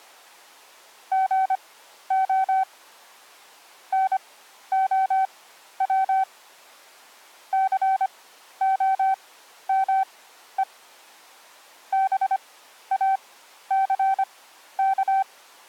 Morse code, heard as a keyed tone, machine-sent, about 25 wpm, spaced as for 12 wpm, 770 Hz. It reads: GO NOW COME BACK